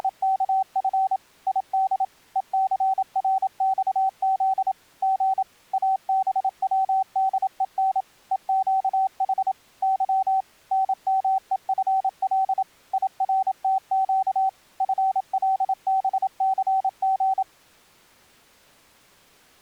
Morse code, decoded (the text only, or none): … ID ECRXZ G ABWDEN EQH Y NMEFL IRTQ FLBCG